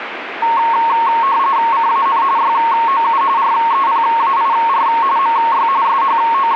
RTTY (45.45 baud, 170 Hz shift), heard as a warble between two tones, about 1000 Hz centre, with radio static. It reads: CAN YOU REPAIR MY …